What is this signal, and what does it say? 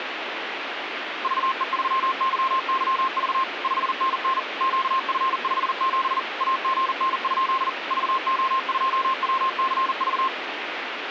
Morse code, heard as a keyed tone, machine-sent, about 40 wpm, 1060 Hz, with radio static. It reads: VE3YYV 5NN QF57 AGN? VO2WCV